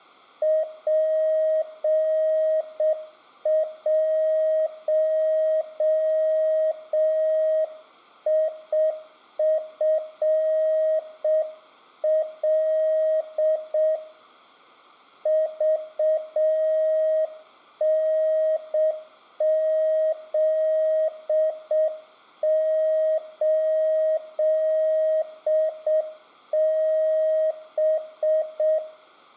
Morse code, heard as a keyed tone, hand-sent with a straight key, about 6 wpm, 630 Hz, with room echo. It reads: P1IFL VNZ8B